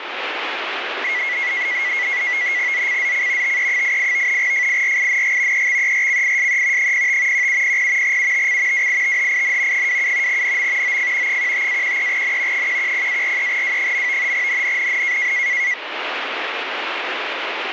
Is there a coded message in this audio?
Yes: NAVTEX (SITOR-B), 100 baud, 170 Hz shift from 1.0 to 15.7 s, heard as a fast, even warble, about 2050 Hz centre, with radio static. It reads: ZCZC TE88 FIRING EXERCISE 05 1700 UTC WITHIN 27 NM OF 15-13N 110-43W. NNNN